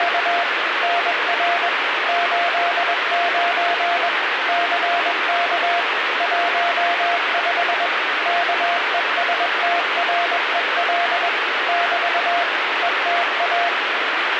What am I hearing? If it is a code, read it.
Morse code, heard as a keyed tone, machine-sent, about 21 wpm, 690 Hz, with radio static. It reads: … NR 89 CK 15 KESTREL <BT> ETA